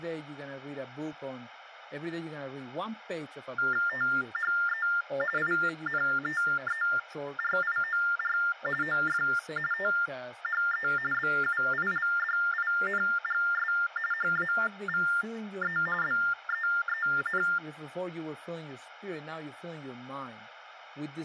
TTY/TDD text telephone tones (45.45 baud Baudot), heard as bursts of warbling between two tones, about 400 Hz shift, 1600 Hz centre, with speech in English. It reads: THE INTERIOR OF THE BUILDINGS HAVE BEEN